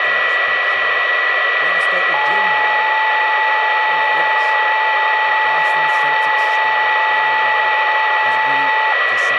PSK31 (31.25 baud), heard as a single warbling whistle, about 870 Hz, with radio static, a steady whistle near 1950 Hz and speech in English.